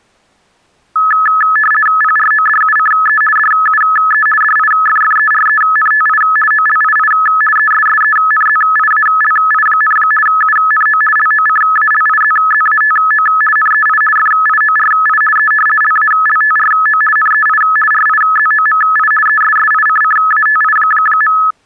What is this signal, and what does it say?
RTTY (50 baud, 450 Hz shift), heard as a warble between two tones, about 1500 Hz centre. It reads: PRODUCE DUE DIFFERENTI OLII ESSENZIALI, UNO LOCALIZZATO NEI FIORI E LALTRO NEI RIZOMI ESSICCATI.